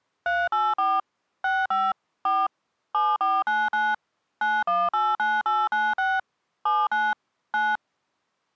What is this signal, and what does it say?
DTMF, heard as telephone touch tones, dialled by machine, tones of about 220 ms. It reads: 384 65 4 7499 9189896 79 9